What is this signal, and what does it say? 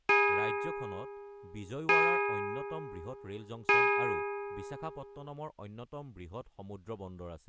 Clock strike, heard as a bell, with speech in Assamese. 3. Three o'clock.